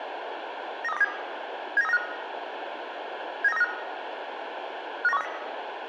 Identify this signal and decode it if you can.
Five-tone selective call (EEA), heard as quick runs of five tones, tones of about 40 ms, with radio hiss and room echo. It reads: 93207 79395 79395 59130